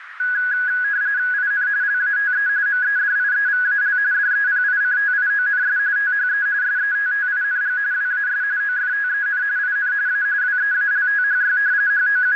RTTY (45.45 baud, 170 Hz shift), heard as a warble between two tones, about 1550 Hz centre, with radio static and a narrow filter. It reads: IN LATE MEDIEVAL DEPICTIONS THE SETTING WAS OFTEN IN A WEALTHY …